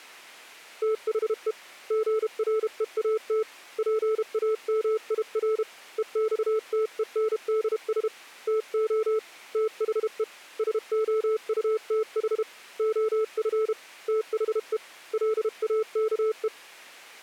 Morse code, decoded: THE GREAT PAMIR EXTENDS TO THE SOUTH OF THE LAKE

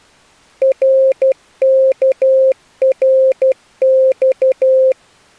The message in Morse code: RKRX

